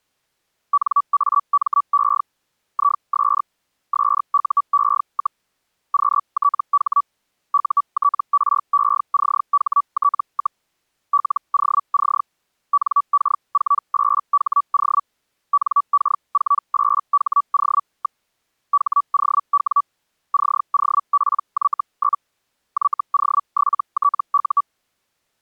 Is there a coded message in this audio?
Yes: Hellschreiber (Feld-Hell, 122.5 baud) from 0.7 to 24.6 s, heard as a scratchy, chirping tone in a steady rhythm, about 1150 Hz. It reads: NAME IS SUE, QTH UTRECHT, LOC NK48HO NK48HO. HOW COPY? YO7TU